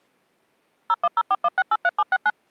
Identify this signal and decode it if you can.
DTMF, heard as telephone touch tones, dialled by machine, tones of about 40 ms. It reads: 01041683769